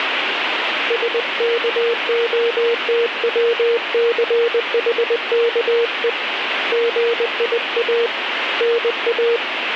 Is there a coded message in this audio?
Yes: Morse code (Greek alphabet) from 0.8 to 9.4 s, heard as a keyed tone, hand-sent with a paddle, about 20 wpm, 470 Hz, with radio static. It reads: ΣΚΟΤΩΘΗΚΕ ΓΙΑ ΝΑ